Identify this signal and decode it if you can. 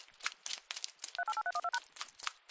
DTMF, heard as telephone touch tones, dialled by machine, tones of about 50 ms, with hum. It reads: 388312#